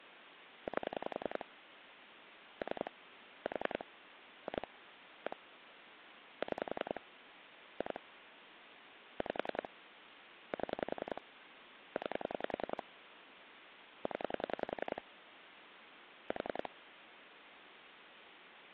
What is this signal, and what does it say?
Pulse dialling, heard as clicks on a phone line, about 10 pulses a second, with phone line noise. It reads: 8 3 4 2 1 6 2 5 7 9 0 4